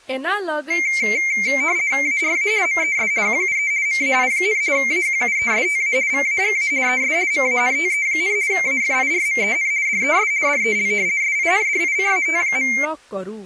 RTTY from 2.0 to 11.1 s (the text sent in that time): ARA MES QUE MAI, AQUESTA VAGA ES MANTE, AFIRMEN DES DEL